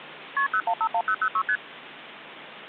Multi-frequency trunk signalling (R1, as on North American trunks), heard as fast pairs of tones, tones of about 70 ms, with phone line noise. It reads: KP 0151006 ST